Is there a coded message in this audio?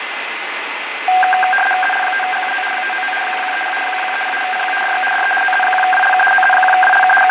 Yes: RTTY (75 baud, 850 Hz shift) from 1.1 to 7.3 s, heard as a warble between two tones, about 1170 Hz centre, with radio static and fading. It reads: ZL5GUO 599 1130 1130 CQ DX DE OZ1WLK OZ1WLK …